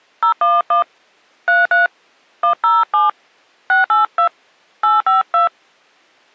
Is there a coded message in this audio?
Yes: DTMF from 0.2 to 5.5 s, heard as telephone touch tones, dialled by hand, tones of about 140 ms. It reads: 011 33 107 682 852